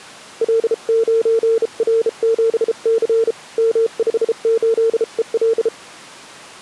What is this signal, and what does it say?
Morse code, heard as a keyed tone, hand-sent with a bug key, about 33 wpm, 450 Hz. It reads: L9R7C M58EL